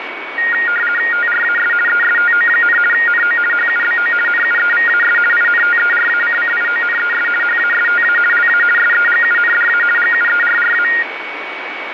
RTTY (50 baud, 450 Hz shift), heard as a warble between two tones, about 1650 Hz centre, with radio static and a steady whistle near 2250 Hz. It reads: TRAS ESTO, NO HUBO NUEVAS INTERACCIONES HASTA LA SEGUNDA GUERRA